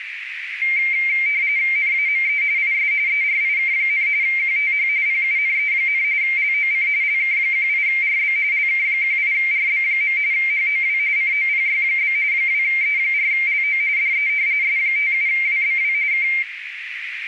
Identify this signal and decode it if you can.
RTTY (45.45 baud, 170 Hz shift), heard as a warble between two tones, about 2200 Hz centre, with radio static and a narrow filter. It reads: NAME IS ERIK, QTH PUNE, LOC LK18RB LK18RB. HOW COPY? 2E4LO DE S57WBW K